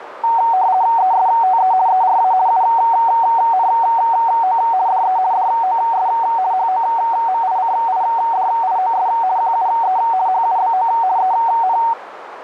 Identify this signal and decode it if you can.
RTTY (50 baud, 170 Hz shift), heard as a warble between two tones, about 830 Hz centre, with radio static and a narrow filter. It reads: ESTE ERA UNO DE DOS HOMICIDIOS QUE HUBO EN